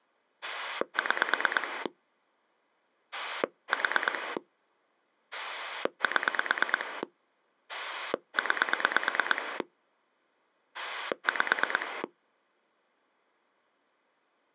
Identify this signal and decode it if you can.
Pulse dialling, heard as a rotary dial, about 9 pulses a second. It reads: 6 4 7 9 5